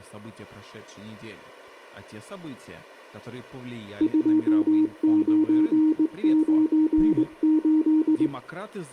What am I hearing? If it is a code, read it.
Morse code, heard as a keyed tone, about 20 wpm, 310 Hz, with room echo and speech in Russian. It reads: 2998